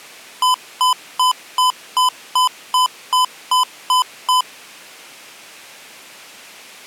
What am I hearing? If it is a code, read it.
Beep code, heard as beeps from a small speaker, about 1010 Hz. 11 short. In AMI BIOS tables: cache memory error.